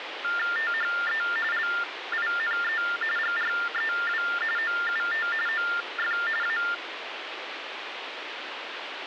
TTY/TDD text telephone tones (45.45 baud Baudot), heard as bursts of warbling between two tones, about 400 Hz shift, 1600 Hz centre, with phone line noise. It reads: THE LINE GREW OUT OF A